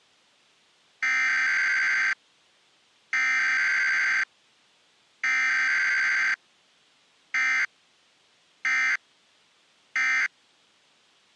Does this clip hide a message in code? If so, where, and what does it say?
Yes: Emergency Alert System (SAME) tones (header bursts, then end-of-message bursts) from 1.0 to 10.3 s, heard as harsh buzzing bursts, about 520.83 baud.